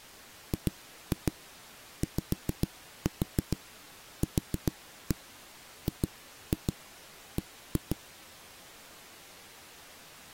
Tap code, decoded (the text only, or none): GYQGB